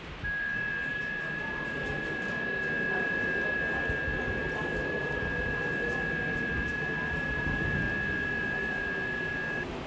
FT8 (several signals at once), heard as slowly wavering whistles, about 6.25 baud, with radio static and the noise of a subway station.